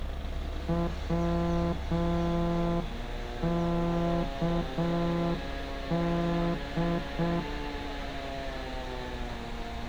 Morse code, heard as a horn, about 6 wpm, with street noise. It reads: WKD